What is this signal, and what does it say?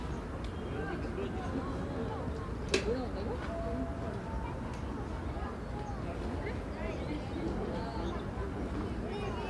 The noise of a residential street. There is no code.